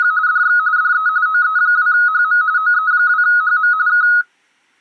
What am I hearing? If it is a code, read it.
RTTY (45.45 baud, 170 Hz shift), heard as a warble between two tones, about 1360 Hz centre. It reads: … DX DE OE2HM OE2HM K